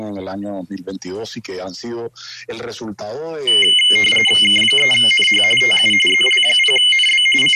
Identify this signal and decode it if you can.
RTTY (45.45 baud, 850 Hz shift), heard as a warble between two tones, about 2550 Hz centre, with room echo. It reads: K3NH TU ZL0NB …